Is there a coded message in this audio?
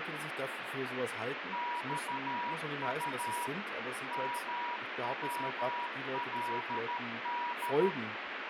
Yes: Morse code (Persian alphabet) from 1.5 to 8.0 s, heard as a keyed tone, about 13 wpm, 960 Hz, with radio static and speech in German. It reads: خط مولد